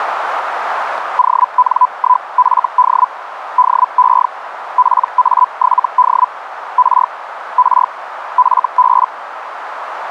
Hellschreiber (Feld-Hell, 122.5 baud), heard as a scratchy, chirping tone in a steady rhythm, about 1000 Hz, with radio static and a narrow filter. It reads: ON1FD DE PA7D R R FB